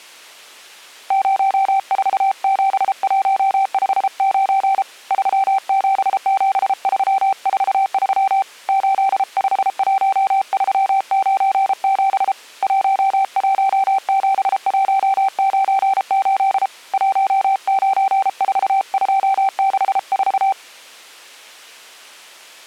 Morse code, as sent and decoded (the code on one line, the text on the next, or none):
----- ....- --... .---- ..... ----. / ...-- --... --... ...-- ....- ...-- / ---.. ..... .---- ...-- ----. --... / .---- .---- --... .---- ----. ---.. / .---- ----. ....- ..--- -.... ....-
047159 377343 851397 117198 194264